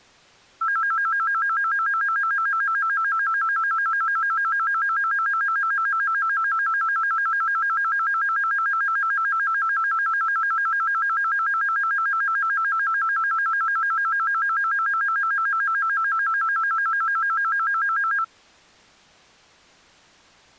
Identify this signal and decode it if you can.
A tone that alternates evenly between two pitches. There is no code.